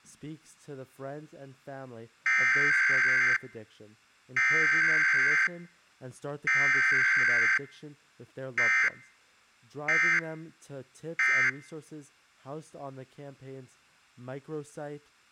Emergency Alert System (SAME) tones (header bursts, then end-of-message bursts), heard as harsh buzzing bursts, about 520.83 baud.